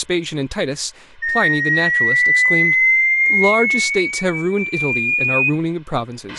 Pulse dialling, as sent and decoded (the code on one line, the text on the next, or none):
none